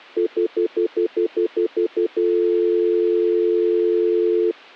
Telephone call progress tone (North American plan), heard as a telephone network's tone, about 350, 440 Hz, 0.1 s on and 0.1 s off. Stutter dial tone.